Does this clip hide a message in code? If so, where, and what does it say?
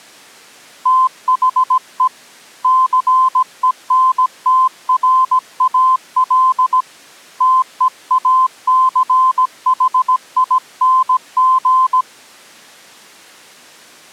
Yes: Morse code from 0.8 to 12.1 s, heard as a keyed tone, hand-sent with a paddle, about 17 wpm, 1040 Hz. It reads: THE CENTRAL TEACHING